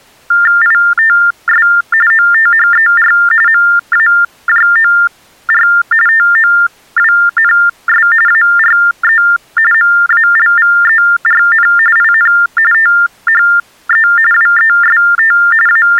TTY/TDD text telephone tones (45.45 baud Baudot), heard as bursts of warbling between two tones, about 400 Hz shift, 1600 Hz centre. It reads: ITS OTHER MAJOR TOWNS ARE MALVERN IN THE WEST …